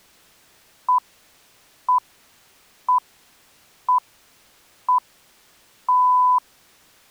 Radio time signal (six pips, as the Greenwich Time Signal), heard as pips.